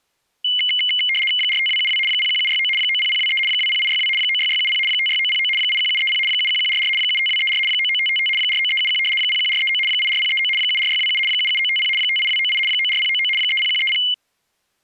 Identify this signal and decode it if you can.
RTTY (75 baud, 850 Hz shift), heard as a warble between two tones, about 2550 Hz centre. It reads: 45272 01769 90023 20862 96670 56909 81730 71144 75234 99555 49371 01439 84039 74627 77950 58298 94099 30130